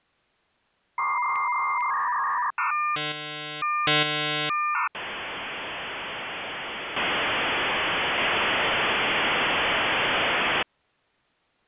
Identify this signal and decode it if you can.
Dial-up modem handshake (V.34 or later), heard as a whistle, warbles, then hiss.